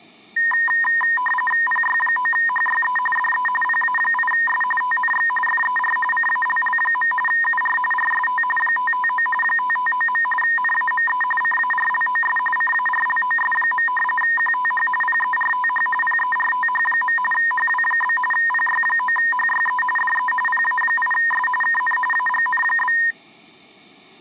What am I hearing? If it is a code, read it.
RTTY (45.45 baud, 850 Hz shift), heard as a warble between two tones, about 1420 Hz centre. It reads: PY9HYE DE PA8S TNX FER CALL. UR RST 559 559. NAME CARLOS CARLOS. QTH PERTH PERTH. HW? PY9HYE DE PA8S KN AGN?